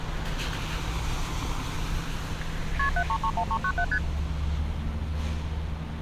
Multi-frequency trunk signalling (R1, as on North American trunks), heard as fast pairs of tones, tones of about 70 ms, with street noise. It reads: KP 7331397 ST